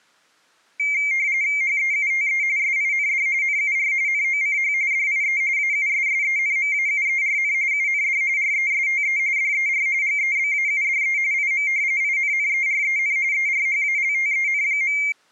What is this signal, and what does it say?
RTTY (45.45 baud, 170 Hz shift), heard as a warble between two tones, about 2200 Hz centre. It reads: HEUTE SIND NUR NOCH DIE AUSSENMAUERN UND RESTE DER GEBAUDE IM INNEREN ERHALTEN.